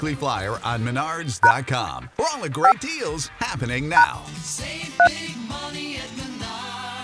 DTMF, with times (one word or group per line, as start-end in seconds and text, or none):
1.4-1.5 #
2.6-2.7 5
4.0-4.0 #
5.0-5.1 3